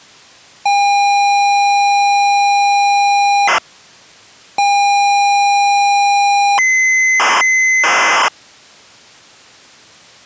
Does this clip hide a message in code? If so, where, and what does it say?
Yes: ZX Spectrum tape loading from 0.7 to 8.3 s, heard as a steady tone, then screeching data.